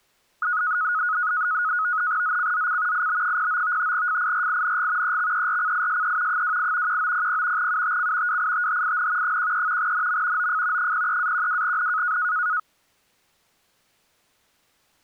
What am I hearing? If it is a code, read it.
NAVTEX (SITOR-B), 100 baud, 170 Hz shift, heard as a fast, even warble, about 1360 Hz centre. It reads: ZCZC IB09 FIRING EXERCISE 28 1900 UTC WITHIN 13 NM OF 03-12N